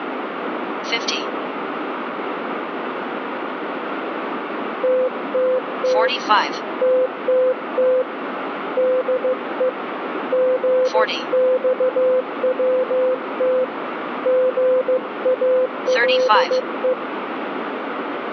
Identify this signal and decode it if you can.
Morse code, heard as a keyed tone, hand-sent with a paddle, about 15 wpm, 510 Hz, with radio static and room echo. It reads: TTT TTT DE GXWT GALE